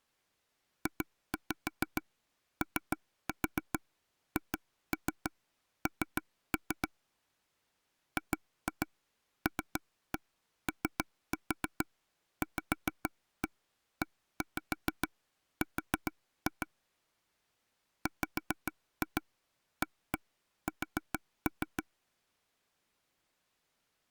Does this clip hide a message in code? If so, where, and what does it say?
Yes: tap code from 0.9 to 21.8 s, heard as taps on a table, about 6 knocks a second. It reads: JOHN GLOVER WAS